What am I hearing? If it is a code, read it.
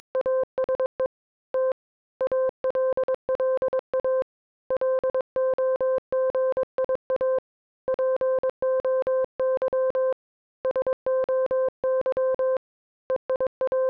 Morse code (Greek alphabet), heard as a keyed tone, hand-sent with a paddle, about 22 wpm, 520 Hz. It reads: … Τ ΑΛΛΑ ΛΟΓΙΑ ΠΟΥ ΣΟΥ …